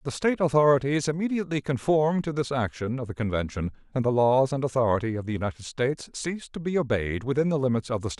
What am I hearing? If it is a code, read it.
Speech in English. There is no code.